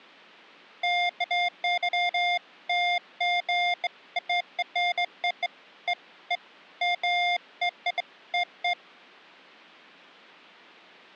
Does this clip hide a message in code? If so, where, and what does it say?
No, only beeps of irregular length.